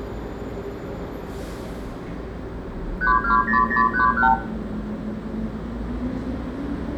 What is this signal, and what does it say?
Multi-frequency trunk signalling (R2, with the far end's replies), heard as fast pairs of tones, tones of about 120 ms, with room echo and the noise of a residential street. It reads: 320031